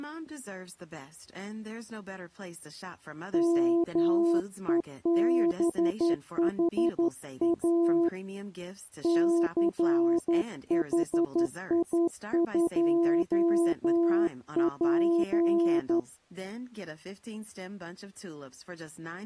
Morse code, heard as a keyed tone, hand-sent with a straight key, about 11 wpm, 340 Hz, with speech in English. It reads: MEBHA CHI2P